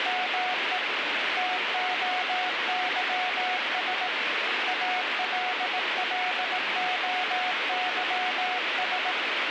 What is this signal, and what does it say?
Morse code (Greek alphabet), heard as a keyed tone, hand-sent with a paddle, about 18 wpm, 730 Hz, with radio static and speech in English. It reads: ΜΕ ΤΟΥΣ ΑΛΛΟΥΣ